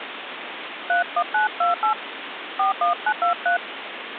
DTMF, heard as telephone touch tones, dialled by hand, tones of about 110 ms, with phone line noise. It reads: 31928 41923